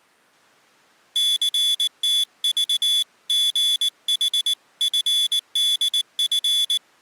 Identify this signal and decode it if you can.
Morse code (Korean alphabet), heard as a high beeper, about 19 wpm, 3450 Hz. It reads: 철수는